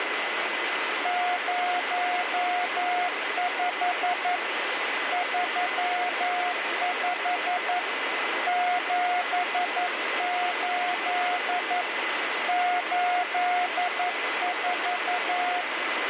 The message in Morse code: 05 35 78 84

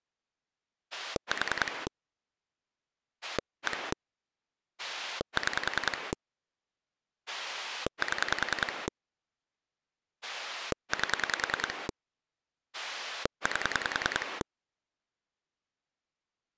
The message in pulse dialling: 4 1 6 7 8 8

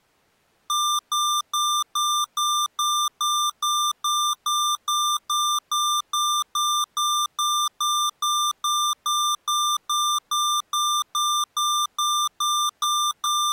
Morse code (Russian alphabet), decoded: none

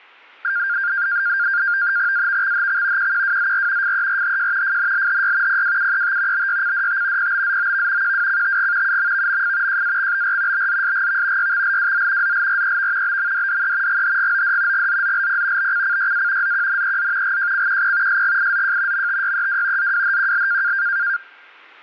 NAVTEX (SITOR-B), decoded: AVXHX QQWZR FERHJ FNLHY PWUET BYCDT PBZOV QWCTG UMVMF JAXBR BZSGV YXLWZ ZLREV BMDDE GHGOD GZZLP BCCYA ZQNEZ GJCQP SGIZJ MTYEW ZWHQL

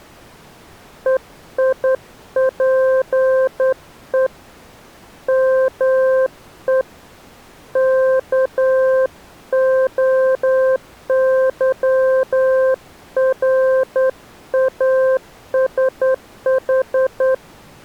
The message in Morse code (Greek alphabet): ΕΙΠΕ ΜΕ ΚΟΥΡΑΣΗ

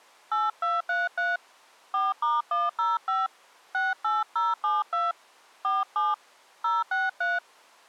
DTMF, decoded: 8233 4*105 68072 47 063

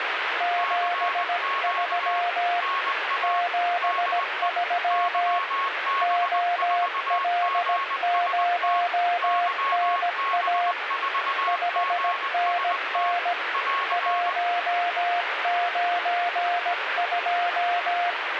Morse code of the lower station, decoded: 73 73 OL0NA 5NN 192

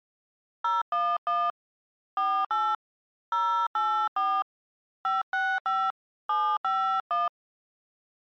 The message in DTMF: 011 48 084 565 751

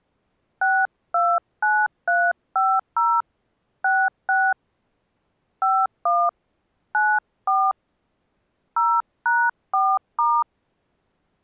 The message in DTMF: 629350 66 51 94 0#4*

